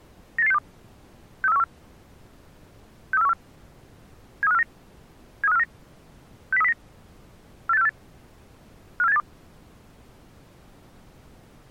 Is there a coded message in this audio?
Yes: five-tone selective call (EEA) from 0.4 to 9.2 s, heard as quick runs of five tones, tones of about 40 ms. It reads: 98862 63414 63414 73549 73549 60309 48648 54782